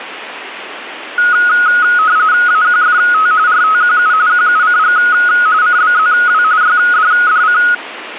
RTTY (45.45 baud, 170 Hz shift), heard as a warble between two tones, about 1360 Hz centre. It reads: AQFT RTQU QUCG CBZW YDDC